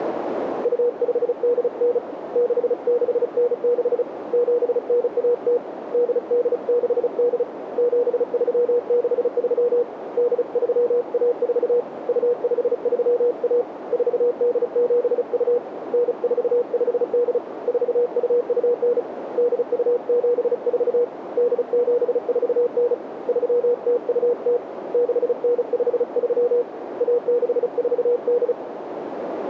Morse code (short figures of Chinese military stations), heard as a keyed tone, hand-sent with a paddle, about 35 wpm, 480 Hz, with radio static and a narrow filter. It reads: 2589 6696 7910 8868 7363 8314 2531 4872 9458 4229 8274 8749 3020 6953 1648